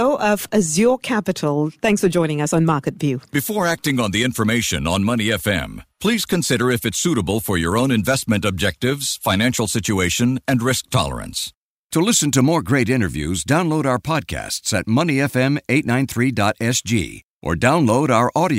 Speech in English. There is no code.